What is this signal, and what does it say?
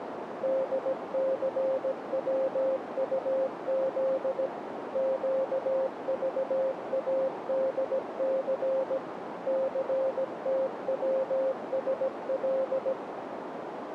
Morse code, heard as a keyed tone, machine-sent, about 17 wpm, 530 Hz, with radio static and a narrow filter. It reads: DCWUZ QVADC CTWSL